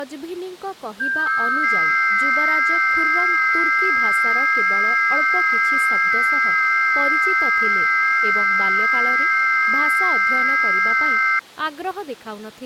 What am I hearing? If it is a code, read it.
FT8 (several signals at once), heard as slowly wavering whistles, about 6.25 baud, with speech in Odia.